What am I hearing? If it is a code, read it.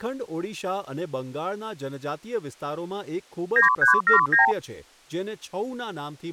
Multi-frequency trunk signalling (R2, with the far end's replies), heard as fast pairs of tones, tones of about 130 ms, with speech in Gujarati. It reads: 9379